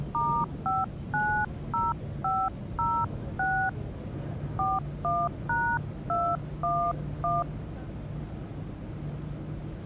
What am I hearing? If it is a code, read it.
DTMF, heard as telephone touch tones, dialled by hand, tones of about 250 ms, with the noise inside a subway train. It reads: *590506 41#211